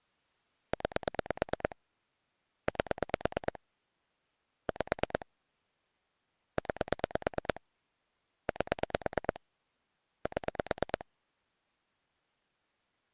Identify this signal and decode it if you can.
Pulse dialling, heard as clicks on a phone line, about 9 pulses a second. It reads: 9 8 5 9 8 7